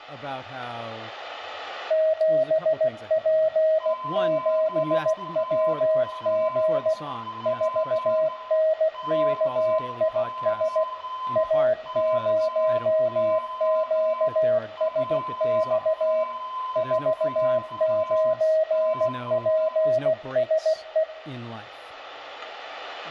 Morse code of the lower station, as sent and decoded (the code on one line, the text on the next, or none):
--... .--. --... .-- --. / ....- -. -.- .. ... / .- ----- --.- ... -..- / ....- ----. .--. ... .
7P7WG 4NKIS A0QSX 49PSE